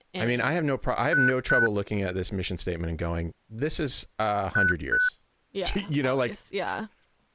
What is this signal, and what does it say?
Beep code, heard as beeps from a small speaker, played twice, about 1490 Hz, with speech in English. 2 short. In AMI BIOS tables: memory parity error; in IBM BIOS tables: self-test error shown on screen; in Dell tables: no memory detected.